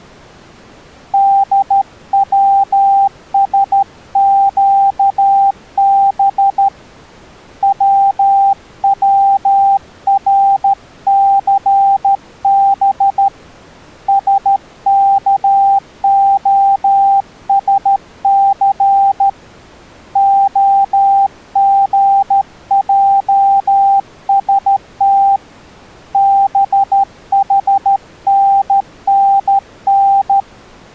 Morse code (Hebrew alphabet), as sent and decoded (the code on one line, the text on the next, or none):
-.. .-- ... --.- -... / .-- .-- .-. -.-. -... / ... -.- --- ... -.-. / --- --. .--- ... - / -... .... -. -. -.
דצשקב צצרסב שכהשס הגעשת בחננן